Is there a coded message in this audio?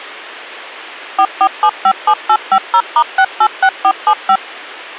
Yes: DTMF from 1.2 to 4.4 s, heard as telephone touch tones, dialled by machine, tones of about 70 ms. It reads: 44757850*686475